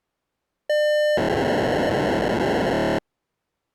POCSAG pager data (1200 baud), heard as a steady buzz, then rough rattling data.